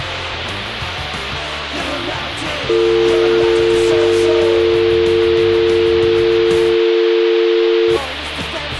Telephone call progress tone (North American or UK plan), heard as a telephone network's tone, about 350, 450 Hz, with phone line noise. Dial tone.